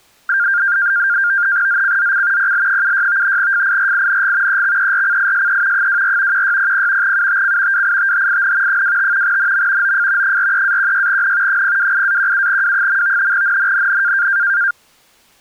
NAVTEX (SITOR-B), 100 baud, 170 Hz shift, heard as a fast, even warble, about 1500 Hz centre. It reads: ZCZC PL76 FIRING EXERCISE 24 1600 UTC WITHIN 25 NM OF 43-16N 028-17W. NNNN